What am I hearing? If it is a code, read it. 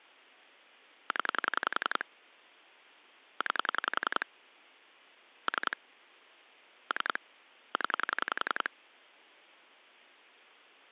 Pulse dialling, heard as clicks on a phone line, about 11 pulses a second. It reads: 0 9 3 3 0